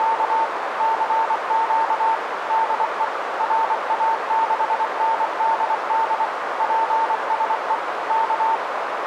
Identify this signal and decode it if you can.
Morse code, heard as a keyed tone, machine-sent, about 24 wpm, 900 Hz, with radio static and a narrow filter. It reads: … CQ DE RA6NDD PSE K